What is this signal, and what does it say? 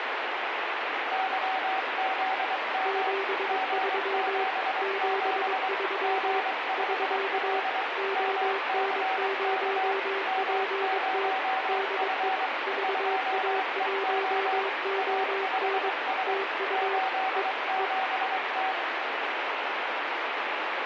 Morse code, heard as two keyed tones, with heavy radio static. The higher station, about 23 wpm, 760 Hz: YZM G77 G5L MCK M0F 2EO A5S 87T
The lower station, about 22 wpm, 390 Hz: 73 73 <SK> ON0PT DE VA1ON TU E E